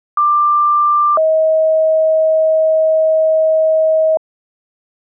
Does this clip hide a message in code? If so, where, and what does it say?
Yes: two-tone page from 0.2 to 4.2 s, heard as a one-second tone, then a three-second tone, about 1180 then 630 Hz.